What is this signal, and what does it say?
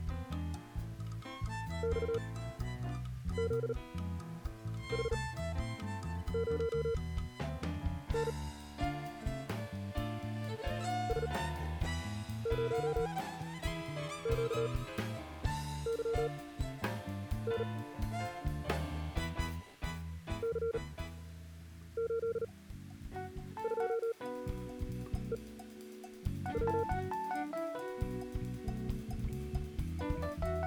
Morse code, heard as a keyed tone, machine-sent, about 38 wpm, spaced as for 7 wpm, 460 Hz. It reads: XZH0N S0QYN C82EW